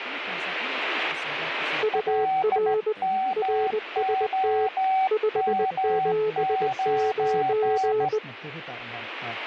Morse code, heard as two keyed tones, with radio static and speech in Finnish. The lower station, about 20 wpm, 430 Hz: UR RST 579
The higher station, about 16 wpm, 760 Hz: LMOM9